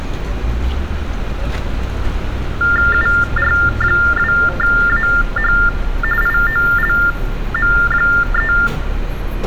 TTY/TDD text telephone tones (45.45 baud Baudot), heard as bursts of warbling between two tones, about 400 Hz shift, 1600 Hz centre, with street noise. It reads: UR2AH IOLM3